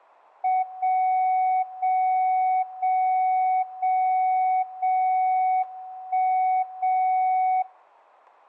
Radio time signal (WWVB), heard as a tone whose level steps once a second, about 750 Hz, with room echo. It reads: 0 0 0 0 0 1 0